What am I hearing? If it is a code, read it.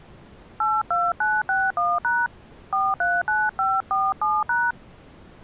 DTMF, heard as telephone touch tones, dialled by hand, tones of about 220 ms. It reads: 82961# 439547#